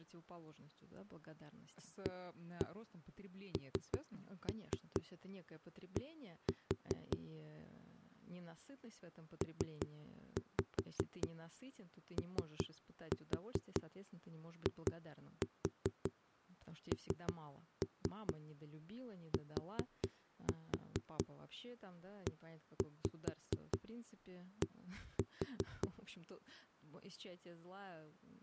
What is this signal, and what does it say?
Tap code, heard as knocks on a wall, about 5 knocks a second, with speech in Russian. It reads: AND POINTED